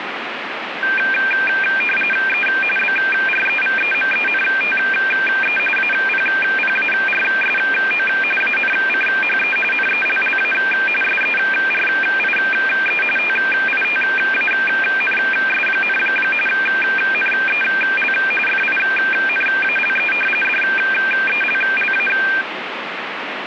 RTTY (45.45 baud, 850 Hz shift), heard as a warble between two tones, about 2000 Hz centre, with radio static. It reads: E BREVEMENTE APPARSO ANCHE NELLA SERIE TITANS, NEL FINALE DELLA